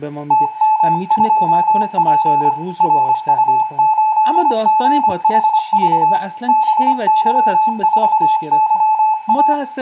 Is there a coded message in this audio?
Yes: Morse code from 0.2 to 9.6 s, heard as a keyed tone, hand-sent with a paddle, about 25 wpm, 870 Hz, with room echo and speech in Persian. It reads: TM2P RU8GHV BY4YA